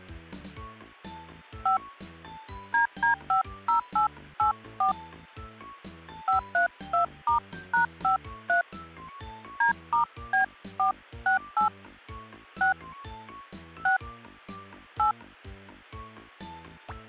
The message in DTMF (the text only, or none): 5 DD50884 532*#53 D*B468 6 6 8